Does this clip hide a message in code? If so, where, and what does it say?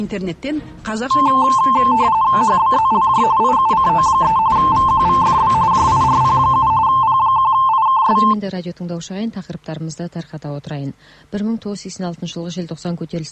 Yes: RTTY (45.45 baud, 170 Hz shift) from 1.1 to 8.3 s, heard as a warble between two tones, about 970 Hz centre. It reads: HBZLJ IUCO3 VQVFB JIRP7 P1IKS